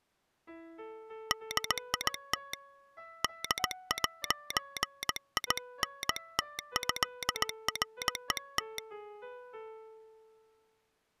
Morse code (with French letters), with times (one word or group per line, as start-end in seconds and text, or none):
1.3-2.5 DIT
3.2-8.8 D'INTÉRET